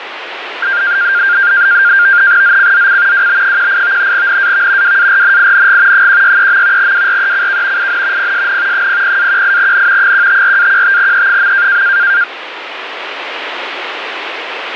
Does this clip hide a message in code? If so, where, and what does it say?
Yes: NAVTEX (SITOR-B), 100 baud, 170 Hz shift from 0.6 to 12.2 s, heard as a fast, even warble, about 1500 Hz centre, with radio static. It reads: ZCZC WB18 NAV WARNING 163. WRECK IN PSN 00-18N 154-15E.